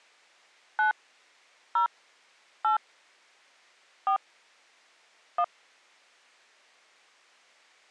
DTMF, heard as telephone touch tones, dialled by hand, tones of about 90 ms. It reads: 9 0 8 4 1